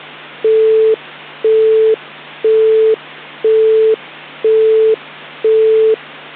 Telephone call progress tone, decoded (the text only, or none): busy tone